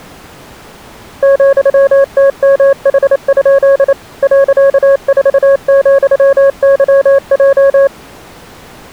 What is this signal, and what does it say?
Morse code, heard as a keyed tone, machine-sent, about 28 wpm, 550 Hz. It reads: ,TMH? .4,YJ